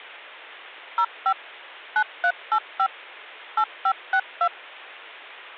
DTMF, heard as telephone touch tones, dialled by machine, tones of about 70 ms. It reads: 05 9385 8562